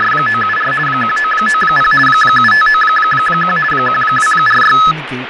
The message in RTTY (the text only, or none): … 1990 7591 1246